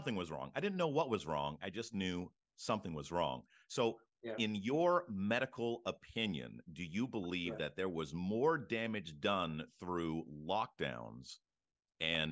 Speech in English. There is no code.